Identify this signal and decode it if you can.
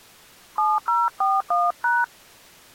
DTMF, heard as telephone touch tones, dialled by hand, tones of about 200 ms. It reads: 7041#